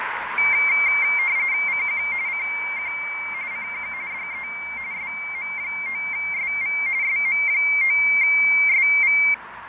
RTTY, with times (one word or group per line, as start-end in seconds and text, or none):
1.7-2.0 CQ
2.3-2.9 CQ
3.5-3.9 CQ
4.1-4.5 DE
4.9-6.8 SM9SV
7.0-9.2 SM9SV